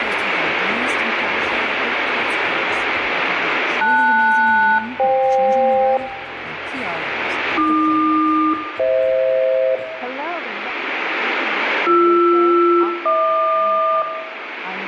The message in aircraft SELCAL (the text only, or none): LS-FK AQ-FH BR-HQ